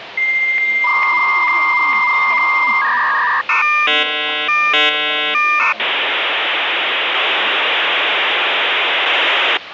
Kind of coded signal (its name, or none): dial-up modem handshake